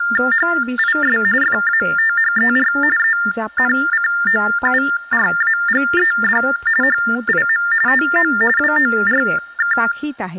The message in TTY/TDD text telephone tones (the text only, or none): HIS FATHER ENCOURAGED HIM TO WORK